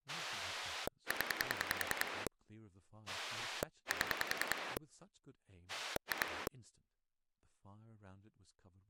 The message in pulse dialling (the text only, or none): 0 7 2